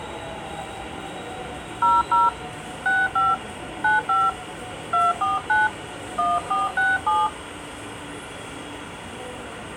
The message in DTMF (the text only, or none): 00 65 95 249 1467